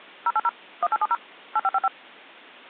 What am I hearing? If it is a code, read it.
DTMF, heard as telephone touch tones, dialled by machine, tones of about 40 ms. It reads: 080 1870 8555